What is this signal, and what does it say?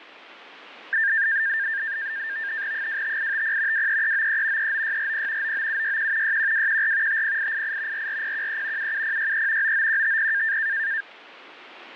NAVTEX (SITOR-B), 100 baud, 170 Hz shift, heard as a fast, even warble, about 1700 Hz centre. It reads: 25850 23393 39640 99761 61214 50888 44013 77063 99150